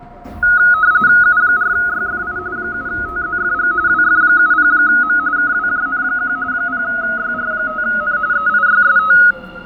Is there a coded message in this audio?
Yes: RTTY (45.45 baud, 170 Hz shift) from 0.4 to 9.3 s, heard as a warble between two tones, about 1360 Hz centre, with fading and the noise inside a subway train. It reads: U4YFI 7TZFG WF70M KWJN1 0YR5N EIYST